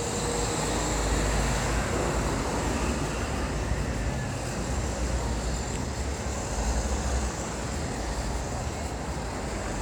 Street noise. There is no code.